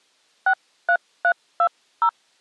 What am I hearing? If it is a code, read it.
DTMF, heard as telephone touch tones, dialled by hand, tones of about 70 ms. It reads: 63320